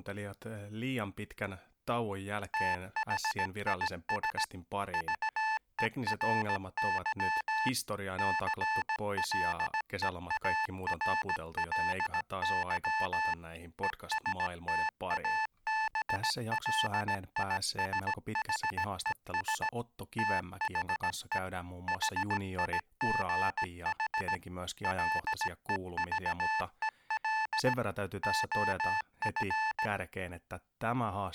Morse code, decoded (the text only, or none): THIS VERY CLEARLY ESTABLISHES THE HIGH LEVEL OF